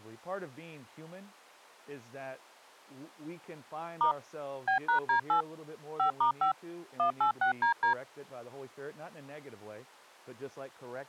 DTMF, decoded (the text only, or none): * B#D8 5*5 186DD